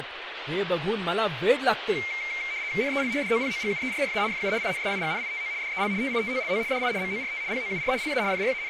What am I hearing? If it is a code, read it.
RTTY (75 baud, 170 Hz shift), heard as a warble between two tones, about 2200 Hz centre, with radio static and speech in Marathi. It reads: NEL DOPOGUERRA FU INSIGNITO DEL TITOLO DI MORT POUR LA …